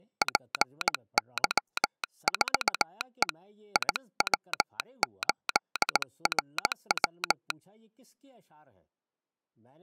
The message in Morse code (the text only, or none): PY4E IW8RW